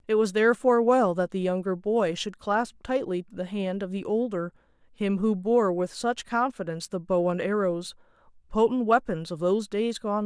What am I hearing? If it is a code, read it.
Speech in English. There is no code.